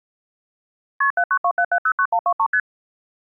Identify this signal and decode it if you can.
Multi-frequency trunk signalling (R1, as on North American trunks), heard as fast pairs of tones, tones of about 70 ms. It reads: KP 7927709123 ST